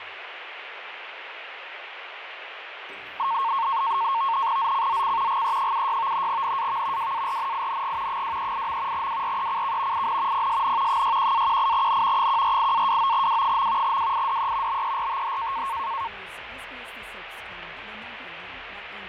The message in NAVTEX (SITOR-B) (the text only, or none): ZCZC GE76 NAV WARNING 238. WRECK IN PSN 61-18N 148-29W. WIDE BERTH